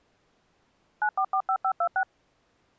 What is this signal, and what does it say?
DTMF, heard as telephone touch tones, dialled by machine, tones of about 70 ms. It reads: 9445526